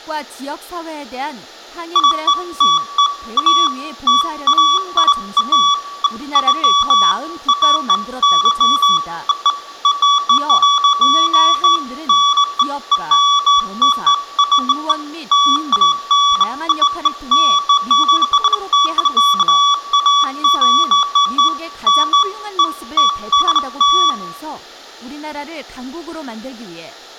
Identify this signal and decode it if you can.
Beeps of irregular length, with room echo and speech in Korean. There is no code.